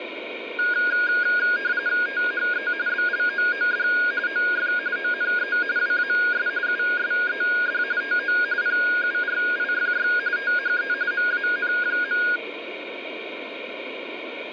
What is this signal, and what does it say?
RTTY (45.45 baud, 170 Hz shift), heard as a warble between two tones, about 1550 Hz centre, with radio static. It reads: THE BLOOD OF ONE WAS USED TO PURIFY THE MAN.